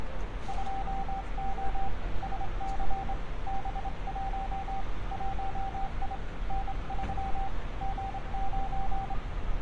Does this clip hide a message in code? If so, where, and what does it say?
Yes: Morse code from 0.4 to 9.2 s, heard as a keyed tone, hand-sent with a straight key, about 26 wpm, 780 Hz, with room echo and street noise. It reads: 2O SC B1 1I N3 G9